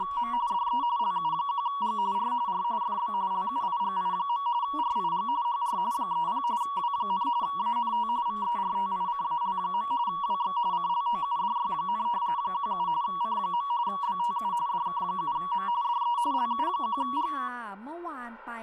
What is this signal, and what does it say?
RTTY (45.45 baud, 170 Hz shift), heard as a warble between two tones, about 1040 Hz centre, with speech in Thai. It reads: … DE LU1G R R FB LUIGI. RIG HR 30 W, ANT VERTICAL. WX CLOUDY, 17 C. BTU DK7M DE LU1G